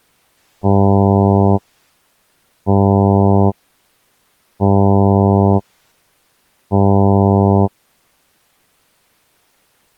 Ship horn signal, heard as a ship's horn, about 100 Hz. 4 short. At sea: a pilot vessel's identity signal in fog.